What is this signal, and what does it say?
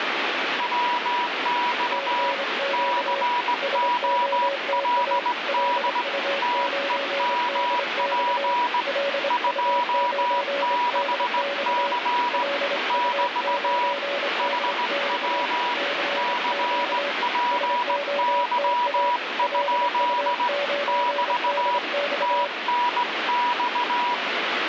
Morse code, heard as two keyed tones, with heavy radio static. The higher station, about 18 wpm, 970 Hz: WX COLD TEMP 26C <BT> HW CPY? <BT> TNX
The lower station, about 26 wpm, 560 Hz: CQ SOTA LU9DX LU9DX LU9DX CQ SOTA LU9DX